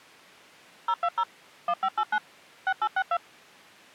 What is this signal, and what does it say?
DTMF, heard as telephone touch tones, dialled by machine, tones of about 60 ms. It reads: 020 1589 6862